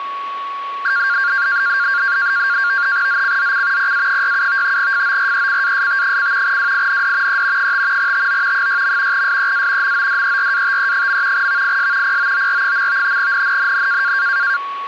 NAVTEX (SITOR-B), 100 baud, 170 Hz shift, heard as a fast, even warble, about 1500 Hz centre, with a steady whistle near 1120 Hz. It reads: ZCZC PA67 FORECAST: WIND E 5 TO 6. SEA MODERATE. VIS POOR. NNNN